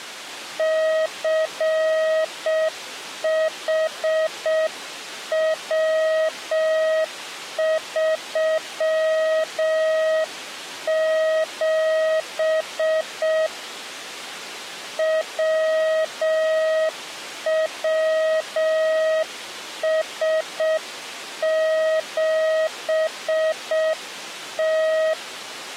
Morse code, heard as a keyed tone, hand-sent with a straight key, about 6 wpm, 630 Hz. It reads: CHW37 WWS7T